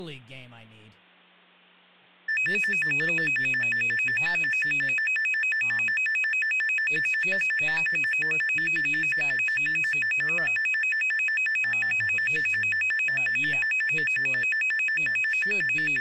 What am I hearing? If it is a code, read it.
A tone that alternates evenly between two pitches, with speech in English. There is no code.